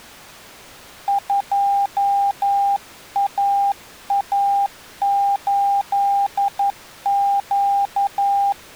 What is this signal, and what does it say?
Morse code, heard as a keyed tone, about 11 wpm, 800 Hz. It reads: 2AA8Q